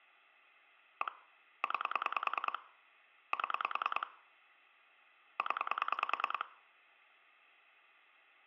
Pulse dialling, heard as clicks on a phone line, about 10 pulses a second, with room echo. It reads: 1 9 7 0